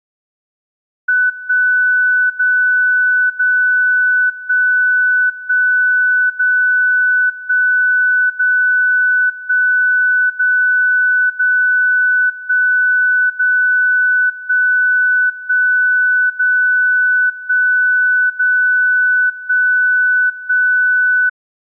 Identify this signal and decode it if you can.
Radio time signal (DCF77), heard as a tone whose level steps once a second, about 1500 Hz. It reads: 1 0 0 1 1 0 1 0 1 0 0 1 0 1 1 0 1 0 1 1